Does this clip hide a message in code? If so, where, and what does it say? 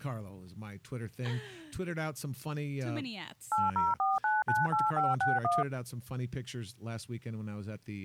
Yes: DTMF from 3.5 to 5.6 s, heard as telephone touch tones, dialled by machine, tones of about 180 ms, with speech in English. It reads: 804998561